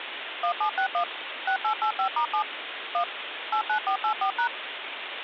DTMF, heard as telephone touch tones, dialled by machine, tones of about 90 ms, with phone line noise. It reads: 1761 6885*7 1 89484#